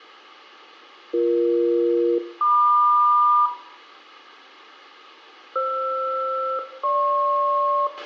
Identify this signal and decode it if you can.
Aircraft SELCAL, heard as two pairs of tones, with a squelch burst at the end and room echo. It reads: BE-MQ FR-GP